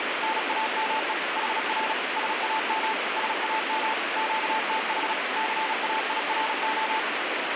Morse code, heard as a keyed tone, machine-sent, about 36 wpm, 880 Hz, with heavy radio static. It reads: NAME HR SAM SAM QTH CAIRO